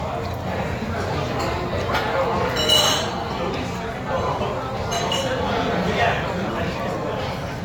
The noise of a restaurant. There is no code.